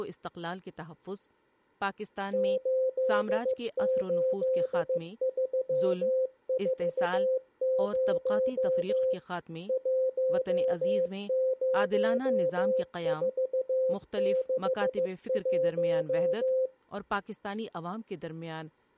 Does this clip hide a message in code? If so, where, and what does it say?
Yes: Morse code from 2.3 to 16.7 s, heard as a keyed tone, machine-sent, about 15 wpm, 520 Hz, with speech in Urdu. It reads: 88340 10461